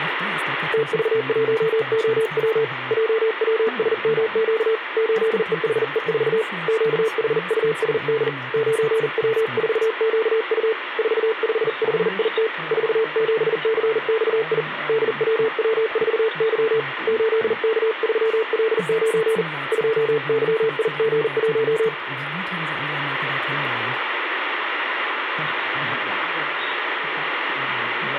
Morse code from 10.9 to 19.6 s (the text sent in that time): 455IT 47CXI DWW4Y 8K3L9